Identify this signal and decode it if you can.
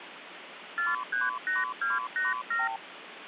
Multi-frequency trunk signalling (R2, with the far end's replies), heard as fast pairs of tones, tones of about 170 ms, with phone line noise. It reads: 438287